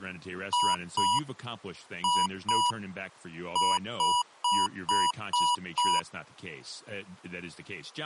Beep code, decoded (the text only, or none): 2-2-6